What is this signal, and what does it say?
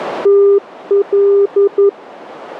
Morse code, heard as a keyed tone, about 11 wpm, 400 Hz, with radio static. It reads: TL